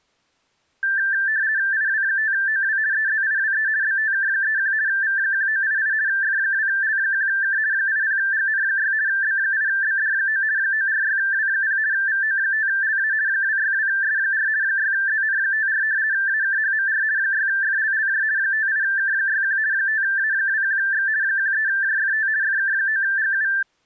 RTTY (50 baud, 170 Hz shift), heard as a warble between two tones, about 1650 Hz centre. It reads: IW5OW EZIWE BTK31 V1988 F2L1K 80GN6 B8BD9 946W0 VO5LA 262S4 6ZN54 AKHMR 6FLLJ 58K61 5A21X 13JFT FK9GU